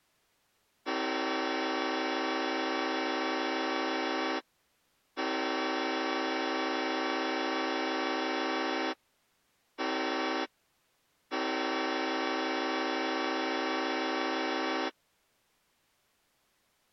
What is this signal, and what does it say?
Train horn signal, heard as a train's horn. 2 long, 1 short, 1 long. On North American railways: approaching a public crossing.